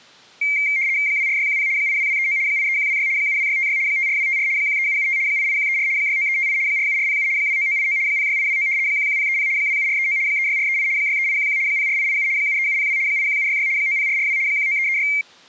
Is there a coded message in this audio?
Yes: RTTY (75 baud, 170 Hz shift) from 0.4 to 15.2 s, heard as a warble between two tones, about 2200 Hz centre. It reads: 24610 82239 83126 72656 54254 13775 88134 69358 47407 29989 06829 11030 27439 36438 63811 04887 73702 81766 90442 19336